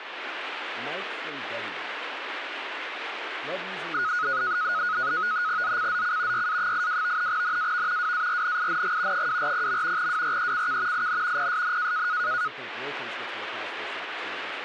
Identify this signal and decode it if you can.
NAVTEX (SITOR-B), 100 baud, 170 Hz shift, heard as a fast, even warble, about 1360 Hz centre, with radio static and speech in English. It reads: ZCZC YA82 NAV WARNING 240. WRECK IN PSN